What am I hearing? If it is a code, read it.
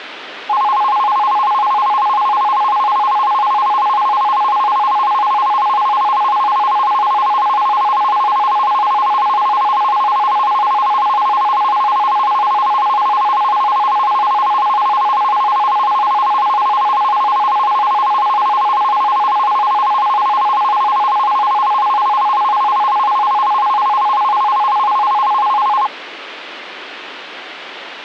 A tone that alternates evenly between two pitches, with phone line noise. There is no code.